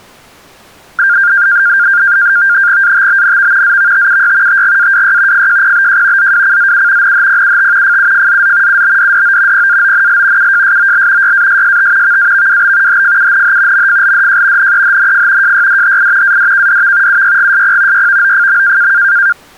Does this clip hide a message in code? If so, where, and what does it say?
Yes: NAVTEX (SITOR-B), 100 baud, 170 Hz shift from 1.0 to 19.3 s, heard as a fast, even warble, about 1500 Hz centre. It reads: ATBNV ZVTUY TGAWY FJPBJ ZWCZU NHPUT FUFZZ UBDDO PAONL UJSOL YASST VAVWB HFUNH MFLDJ NEHNF JYDHI ADKDV UYGSP YVOFM